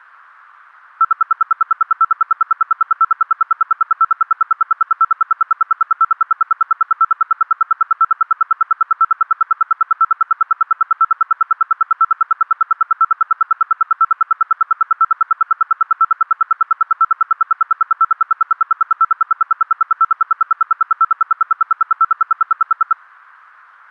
Radio time signal (RWM, Moscow), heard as ten pulses a second.